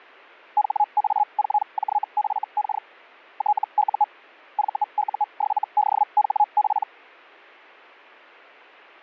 Hellschreiber (Feld-Hell, 122.5 baud), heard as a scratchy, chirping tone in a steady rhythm, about 840 Hz. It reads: HA4JFK TU VU7DHP